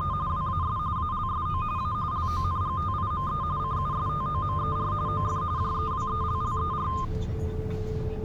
RTTY (45.45 baud, 170 Hz shift), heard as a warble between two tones, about 1130 Hz centre, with the noise inside a car. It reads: … WAS ALSO A LONGTIME CUSTOMER OF JEWELLER